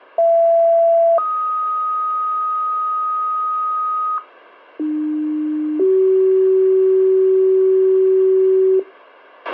Two-tone page, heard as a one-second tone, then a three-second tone, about 670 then 1250 Hz, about 300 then 380 Hz, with a squelch burst at the end.